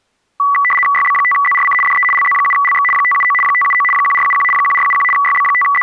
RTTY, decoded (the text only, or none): YB5ZRC DE LZ7LX 579 579 1471 1471 …